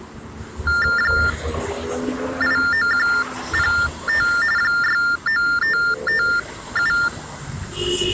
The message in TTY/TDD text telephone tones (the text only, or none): 89105 69557